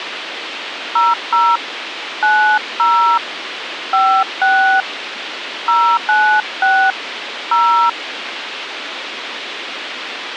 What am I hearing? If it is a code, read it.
DTMF, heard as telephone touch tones, dialled by hand, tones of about 290 ms, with radio hiss. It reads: 00 90 56 096 0